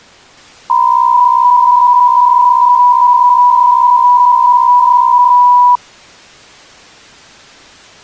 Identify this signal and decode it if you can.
PSK63 (62.5 baud), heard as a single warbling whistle, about 980 Hz.